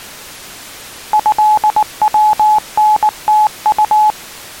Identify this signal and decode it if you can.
Morse code (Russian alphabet), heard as a keyed tone, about 19 wpm, 850 Hz. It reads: ЭВНТУ